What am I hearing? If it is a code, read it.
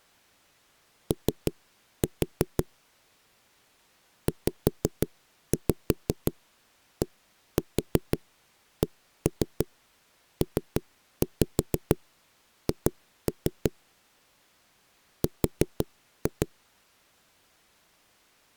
Tap code, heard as knocks on a wall, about 6 knocks a second. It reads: O ZDCPH R